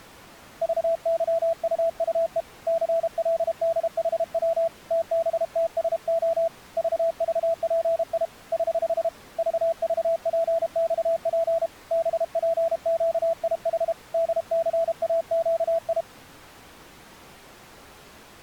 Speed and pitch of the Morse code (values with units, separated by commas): 32 wpm, 660 Hz